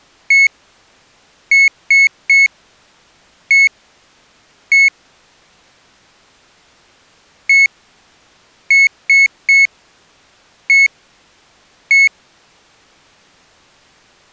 Beep code, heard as a piezo beeper, played twice, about 2200 Hz. 1-3-1-1. In Phoenix BIOS tables: memory refresh test failure.